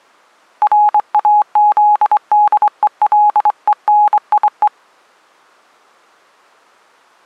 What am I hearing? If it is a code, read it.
Morse code (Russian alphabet), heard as a keyed tone, hand-sent with a straight key, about 23 wpm, 840 Hz. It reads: РАЗДЕЛЕНИЕ